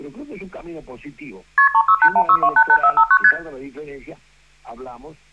Multi-frequency trunk signalling (R1, as on North American trunks), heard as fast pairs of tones, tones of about 70 ms, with room echo. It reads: KP 36816288459 ST